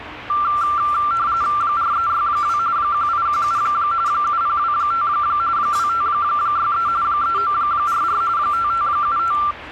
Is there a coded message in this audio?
Yes: RTTY (45.45 baud, 170 Hz shift) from 0.3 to 9.5 s, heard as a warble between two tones, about 1270 Hz centre, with radio static and the noise of a crowd indoors. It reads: 4362 1817 7025 2563 3944 5575